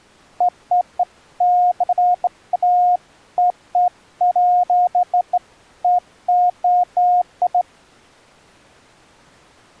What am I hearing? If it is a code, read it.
Beeps of irregular length. There is no code.